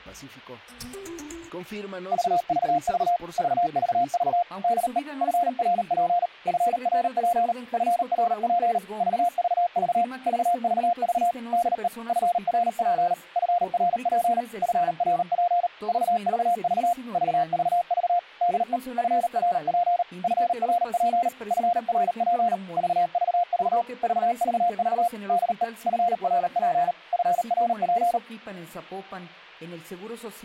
Morse code, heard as a keyed tone, machine-sent, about 38 wpm, 700 Hz, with a squelch burst at the end. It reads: VVV VVV DE FRP FRP FRP VVV VVV DE FRP FRP FRP VVV VVV DE FRP FRP FRP VVV VVV DE FRP FRP